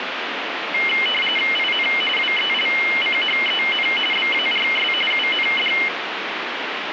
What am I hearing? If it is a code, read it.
RTTY (45.45 baud, 850 Hz shift), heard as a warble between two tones, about 2550 Hz centre, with radio static. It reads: IN WELCHEN BARS UND